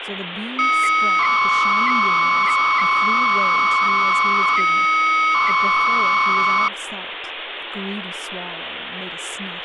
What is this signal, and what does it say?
300-baud modem data (Bell 103 tones), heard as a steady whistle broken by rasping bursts, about 300 baud, 200 Hz shift, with phone line noise and speech in English.